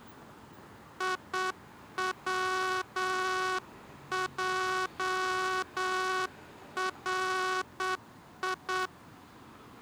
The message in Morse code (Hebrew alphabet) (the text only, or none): יצערי